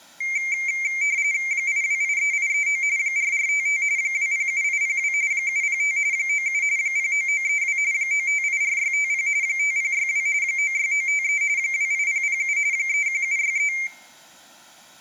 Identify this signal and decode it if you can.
RTTY (45.45 baud, 170 Hz shift), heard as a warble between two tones, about 2200 Hz centre, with room echo. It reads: 8283839 4455 207802 705 97 09932 9584650 5062 96953 28007 31763